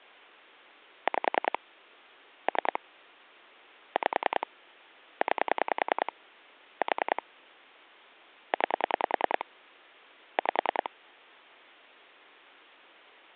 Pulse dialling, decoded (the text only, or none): 5 3 5 9 4 9 5